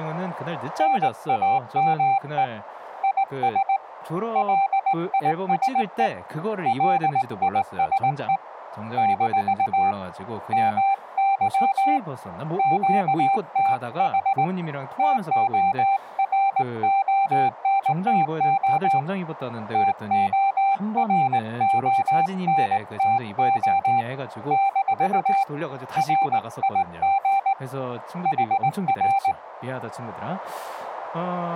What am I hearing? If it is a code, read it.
Morse code, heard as a keyed tone, hand-sent with a straight key, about 19 wpm, 790 Hz, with speech in Korean. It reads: NAME IS LISE LISE - MY QTH TORONTO TORONTO - RIG HR